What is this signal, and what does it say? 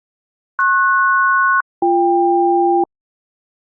Aircraft SELCAL, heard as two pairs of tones. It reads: PS-BK